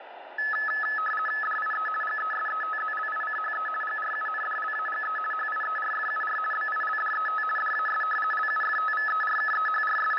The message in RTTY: DIE GESETZLICHE GRUNDLAGE HIERFUR BILDET DAS …

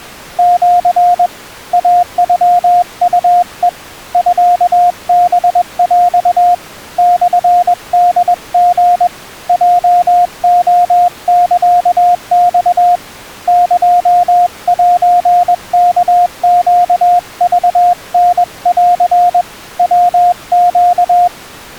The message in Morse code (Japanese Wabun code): シ イノウヘ ミハヰ モホリ ヲレサマ エセワネクタン ヤネ

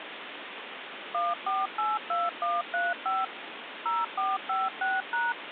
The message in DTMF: 1482135 0456#

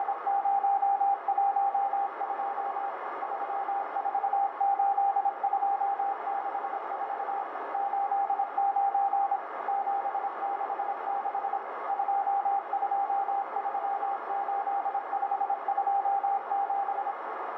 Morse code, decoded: … 348264 89 766 2238527

